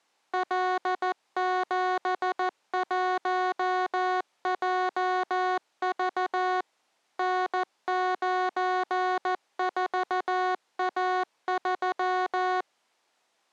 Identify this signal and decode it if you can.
Morse code, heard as electronic beeps, machine-sent, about 14 wpm, 370 Hz. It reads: L71JV N94A3